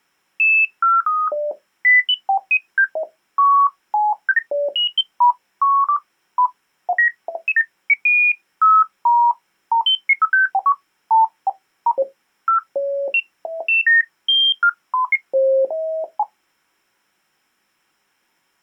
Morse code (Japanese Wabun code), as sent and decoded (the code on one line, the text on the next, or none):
none